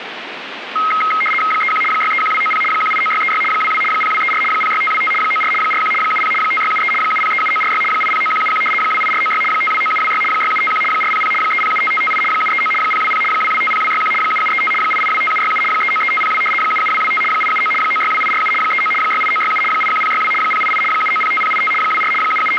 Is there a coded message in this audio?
Yes: RTTY (75 baud, 850 Hz shift) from 0.8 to 22.6 s, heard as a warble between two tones, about 1700 Hz centre, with radio static. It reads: 31 631290 189636 22 0234 06525 94 41 70 5673 7037946 809171 28496 529726 6751 400 3075558 739 020 2250261 7735 8825767 393502 77225 879 962847 39 68967 81062 088 7905085 24 …